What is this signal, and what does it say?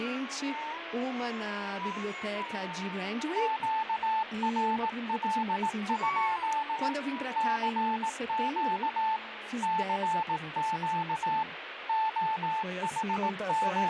Morse code, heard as a keyed tone, machine-sent, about 18 wpm, 880 Hz, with radio static. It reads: QRL? CQ CQ …